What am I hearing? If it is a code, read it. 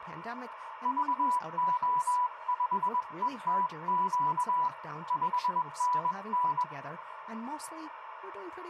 Morse code, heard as a keyed tone, hand-sent with a paddle, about 21 wpm, 990 Hz, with radio static, a narrow filter and speech in English. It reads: VO5ETQ 5NN